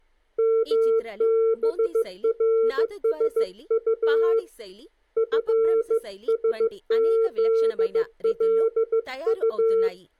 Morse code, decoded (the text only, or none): MBRSU FSZLU